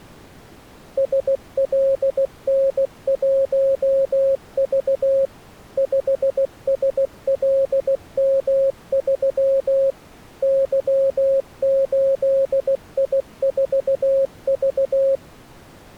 Morse code, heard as a keyed tone, machine-sent, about 16 wpm, 540 Hz. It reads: SLN1V 5SLM3 Y8I4V